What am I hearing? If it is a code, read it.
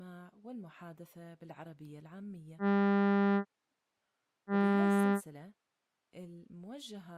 Ship horn signal, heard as a ship's horn, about 200 Hz, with speech in Arabic. 2 short. At sea: I am altering course to port.